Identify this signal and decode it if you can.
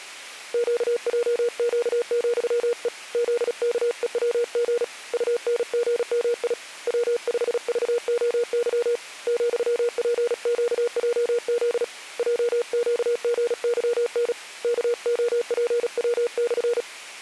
Morse code, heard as a keyed tone, hand-sent with a paddle, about 36 wpm, 480 Hz. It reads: QJQ,E ZKEWG UNGMI W5VOY ,PQJZ JQGYN KOPW/